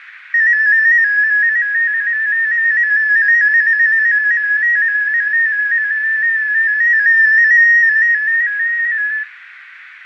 Multi-tone FSK (Olivia or MFSK type), about 250 Hz wide, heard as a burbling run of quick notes, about 15.625 baud, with radio static, fading and room echo.